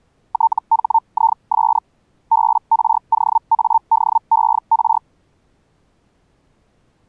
Hellschreiber (Feld-Hell, 122.5 baud), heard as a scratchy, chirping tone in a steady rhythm, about 900 Hz. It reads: THIS BROADER